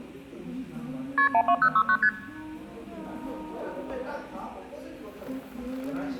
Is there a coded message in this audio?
Yes: multi-frequency trunk signalling (R1, as on North American trunks) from 1.2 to 2.1 s, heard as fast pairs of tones, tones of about 70 ms, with the noise of a cafe. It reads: KP 12069 ST